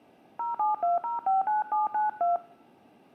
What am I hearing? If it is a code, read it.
DTMF, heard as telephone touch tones, dialled by hand, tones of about 150 ms. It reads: 072059792